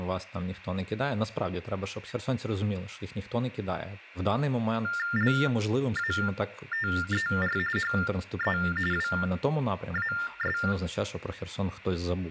TTY/TDD text telephone tones (45.45 baud Baudot), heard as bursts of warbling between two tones, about 400 Hz shift, 1600 Hz centre, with room echo and speech in Ukrainian. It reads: LATER HE WAS